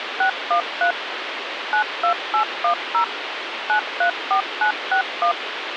DTMF, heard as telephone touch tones, dialled by machine, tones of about 100 ms, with phone line noise. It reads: 613 92810 934961